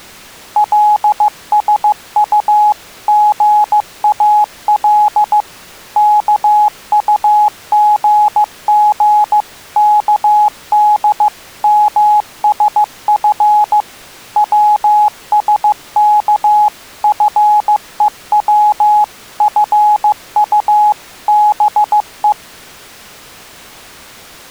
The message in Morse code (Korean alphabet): 계속 있으면 병납니다

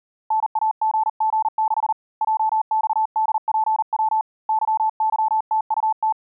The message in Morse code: NAGG6 JXDPW YYTUT

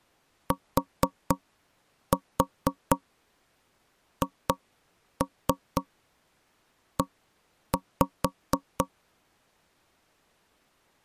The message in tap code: THE

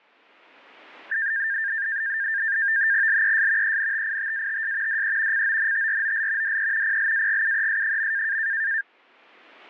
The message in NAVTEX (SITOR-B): LES ENTITATS DE CONTROL DE PLAGUES.

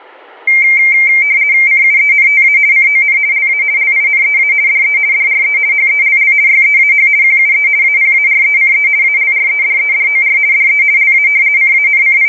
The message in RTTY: CUENTA CON LA LINEA DE DRE HELL YEAH QUE APARECE ALREDEDOR DE LA …

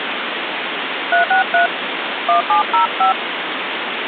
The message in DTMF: 363 1705

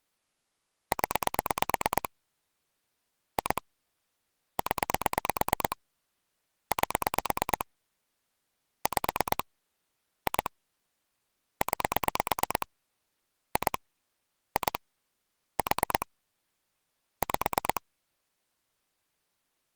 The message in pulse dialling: 0 2 0 8 5 2 9 2 2 4 5

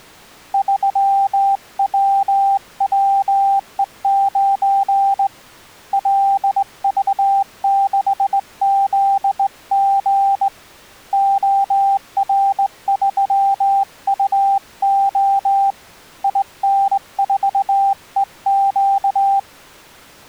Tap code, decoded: none

